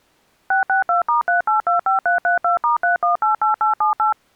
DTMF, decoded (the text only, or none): 662*3825332*3188878